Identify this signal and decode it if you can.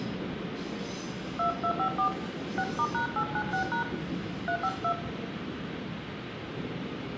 DTMF, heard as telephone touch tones, dialled by hand, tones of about 90 ms, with radio hiss, room echo and the noise inside a subway train. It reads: 2254 6*#896# 352